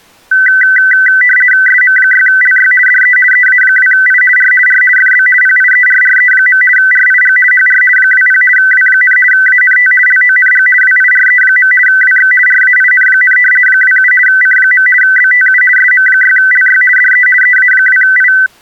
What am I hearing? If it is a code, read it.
RTTY (50 baud, 450 Hz shift), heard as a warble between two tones, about 1750 Hz centre. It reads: SM6LY DE EA2I R R FB PIERRE. RIG HR 20 W, ANT LONG WIRE. WX RAIN, 27 C. BTU SM6LY DE EA2I